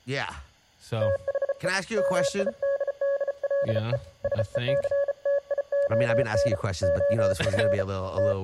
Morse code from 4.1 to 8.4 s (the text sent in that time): SECTION OF …